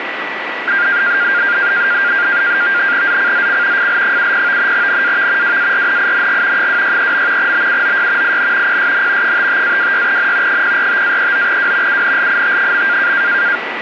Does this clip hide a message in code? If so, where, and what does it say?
Yes: NAVTEX (SITOR-B), 100 baud, 170 Hz shift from 0.7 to 13.6 s, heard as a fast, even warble, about 1500 Hz centre, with radio static and a steady whistle near 1950 Hz. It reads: ZCZC FL70 NAV WARNING 263. BUOY IN PSN 55-26N 045-39W UNLIT.